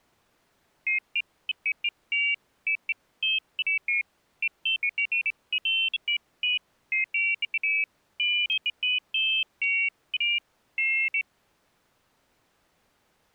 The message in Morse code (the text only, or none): none